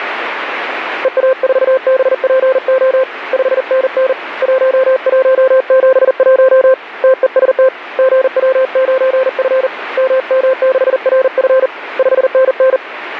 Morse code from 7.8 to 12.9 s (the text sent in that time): GW9F MM6RF 5NN